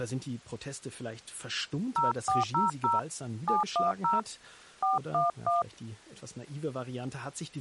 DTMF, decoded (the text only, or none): 0400 710 411